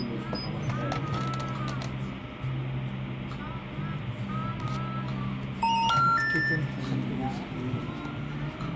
Telephone call progress tone (North American plan), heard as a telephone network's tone, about 910, 1370, 1800 Hz, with hum, room echo and the noise of a cafe. Special information tone.